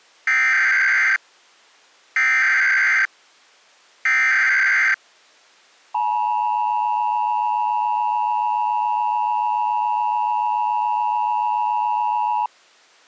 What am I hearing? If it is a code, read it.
Emergency Alert System (SAME) tones (header bursts, then the 853 and 960 Hz attention tone), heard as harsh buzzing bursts, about 520.83 baud.